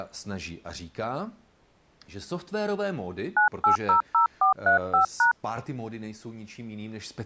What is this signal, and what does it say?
DTMF, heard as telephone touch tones, dialled by hand, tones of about 120 ms, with speech in Czech. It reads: 9800435#